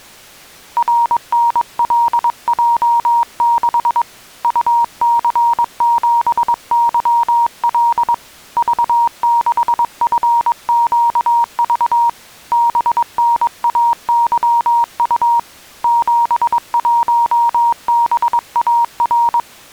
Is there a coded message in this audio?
Yes: Morse code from 0.7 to 19.5 s, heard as a keyed tone, hand-sent with a paddle, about 22 wpm, 940 Hz. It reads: RNLJ6 UC7YL V6FQV BNAYU 71BAR